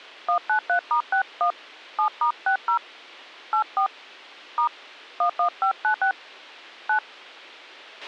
DTMF, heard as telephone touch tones, dialled by hand, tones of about 100 ms, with a squelch burst at the end. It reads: 193*61 7*60 84 * 11596 9